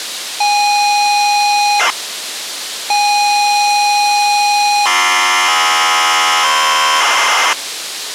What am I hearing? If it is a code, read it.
ZX Spectrum tape loading, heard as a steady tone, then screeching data, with tape hiss.